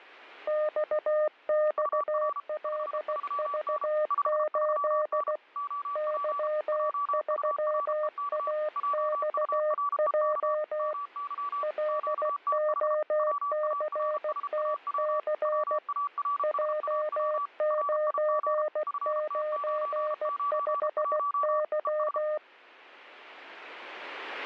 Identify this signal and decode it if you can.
Morse code, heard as two keyed tones. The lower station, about 16 wpm, 610 Hz: XXLV8 Y3AXJ LOCTC J995Y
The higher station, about 33 wpm, 1150 Hz: UR 53N 53N OP JUREK JUREK MY QTH WARSAW WARSAW RIG FT991 ES